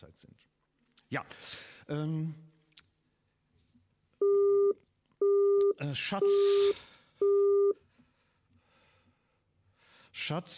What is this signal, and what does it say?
Telephone call progress tone (single-tone plan, as in Europe, Japan and elsewhere), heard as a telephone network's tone, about 400 Hz, 0.5 s on and 0.5 s off. Busy tone.